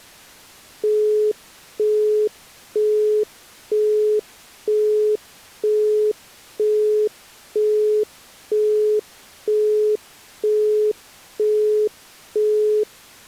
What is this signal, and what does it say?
Telephone call progress tone (single-tone plan, as in Europe, Japan and elsewhere), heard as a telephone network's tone, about 420 Hz, 0.48 s on and 0.48 s off. Busy tone.